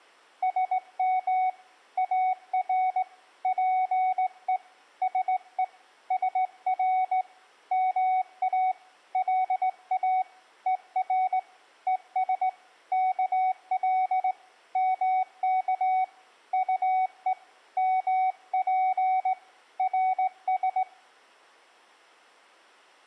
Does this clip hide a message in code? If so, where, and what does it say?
Yes: Morse code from 0.4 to 20.9 s, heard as a keyed tone, hand-sent with a straight key, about 18 wpm, 750 Hz, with room echo. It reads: SM AR PE SE SR MA LA ER ES KL MK UE MP RS